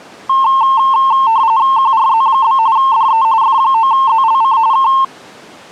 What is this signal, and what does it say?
RTTY (45.45 baud, 170 Hz shift), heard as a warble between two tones, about 980 Hz centre. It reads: QRZ? DE F9ZLC K